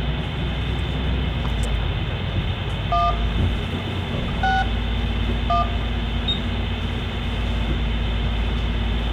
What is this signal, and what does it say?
DTMF, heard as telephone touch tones, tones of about 160 ms, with phone line noise, room echo and the noise inside a bus. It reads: 1 6 1